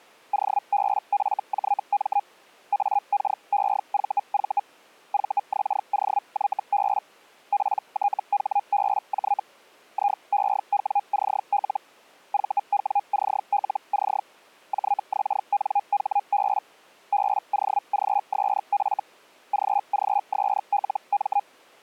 Hellschreiber (Feld-Hell, 122.5 baud), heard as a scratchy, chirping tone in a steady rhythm, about 810 Hz. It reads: OBFJM AKEVV VXOYB PTHBJ IEWCL VWCLC JXNHB BOGSF GGSLM